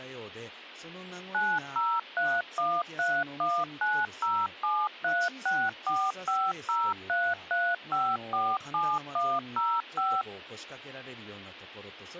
DTMF, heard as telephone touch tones, dialled by machine, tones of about 240 ms, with speech in Japanese. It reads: 9031319073645033547105